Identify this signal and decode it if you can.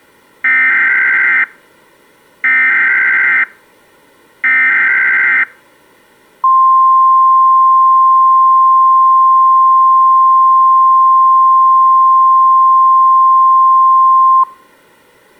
Emergency Alert System (SAME) tones (header bursts, then the 1050 Hz attention tone), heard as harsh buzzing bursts, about 520.83 baud.